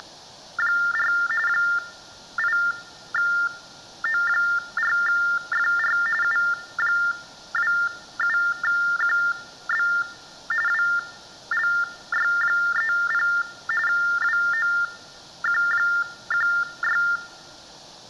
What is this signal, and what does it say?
TTY/TDD text telephone tones (45.45 baud Baudot), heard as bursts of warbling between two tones, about 400 Hz shift, 1600 Hz centre. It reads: … 8O4FR U27QB WLY30 WOQ16